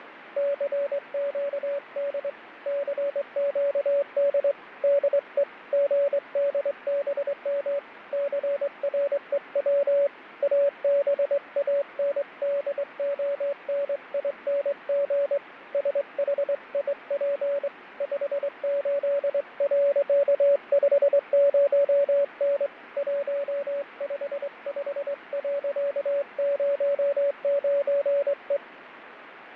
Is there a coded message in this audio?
Yes: Morse code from 0.3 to 28.6 s, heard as a keyed tone, hand-sent with a straight key, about 23 wpm, 570 Hz, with radio static and fading. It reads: CQD CQD DE GDBM CREW ABANDONING SHIP 58.50N 155.09E